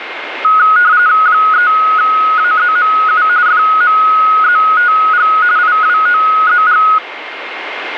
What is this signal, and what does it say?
RTTY (45.45 baud, 170 Hz shift), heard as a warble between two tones, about 1360 Hz centre, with radio static and a steady whistle near 2120 Hz. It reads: 3AZMU FMZTG IWOZG